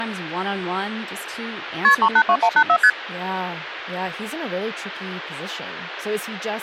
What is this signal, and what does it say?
Multi-frequency trunk signalling (R1, as on North American trunks), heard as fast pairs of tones, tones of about 70 ms, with speech in English. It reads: KP 382184 ST